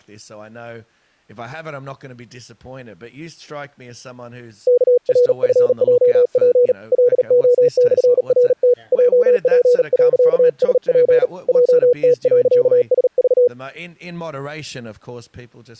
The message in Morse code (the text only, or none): KRFJP LO/RT JP.SP JT.SV